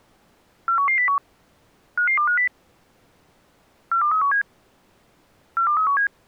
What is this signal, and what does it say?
Five-tone selective call (CCIR), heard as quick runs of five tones, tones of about 100 ms. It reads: 41101 55250 42317 42317